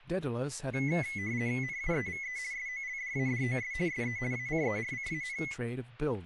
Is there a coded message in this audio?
Yes: RTTY (50 baud, 170 Hz shift) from 0.7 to 5.5 s, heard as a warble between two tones, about 2100 Hz centre, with static crashes and speech in English. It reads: NUEVE SOLDADOS SE ACERCAN